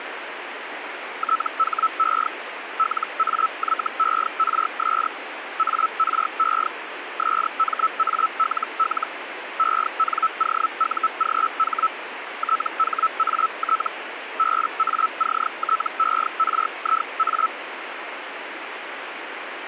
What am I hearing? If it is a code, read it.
Hellschreiber (Feld-Hell, 122.5 baud), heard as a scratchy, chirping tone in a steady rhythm, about 1310 Hz, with radio static. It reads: THE LAYERS ARE SMALL ENOUGH THAT BACTERIA